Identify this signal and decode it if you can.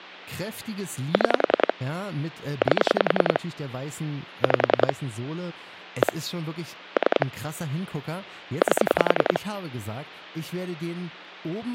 Pulse dialling, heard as clicks on a phone line, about 10 pulses a second, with speech in German. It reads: 6 8 5 1 3 8